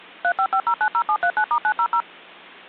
DTMF, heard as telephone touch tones, dialled by machine, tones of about 70 ms. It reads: 355090739*900